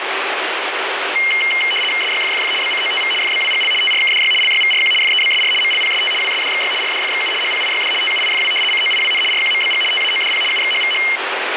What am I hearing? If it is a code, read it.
RTTY (75 baud, 850 Hz shift), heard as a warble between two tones, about 2550 Hz centre, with radio static. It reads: SYFFF BCOTV FBWGL TRKDY LYVRQ FEBSR MLPST WSDXY RDFXU HPIYD TUIFW COIWN RQMBG TAODP UXHVH